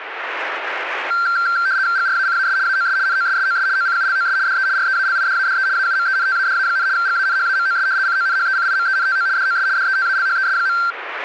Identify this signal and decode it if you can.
RTTY (75 baud, 170 Hz shift), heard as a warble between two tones, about 1470 Hz centre, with radio static. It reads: GRACAS AOS NOSSOS OCULOS DE REALIDADE AUMENTADA, GANHAMOS CONHECIMENTO DOS DETALHES.